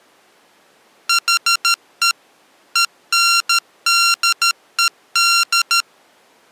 Morse code, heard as electronic beeps, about 13 wpm, 1380 Hz. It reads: HE ENDED